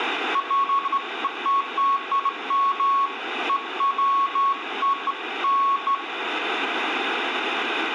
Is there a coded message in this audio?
No, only beeps of irregular length, with radio static and room echo.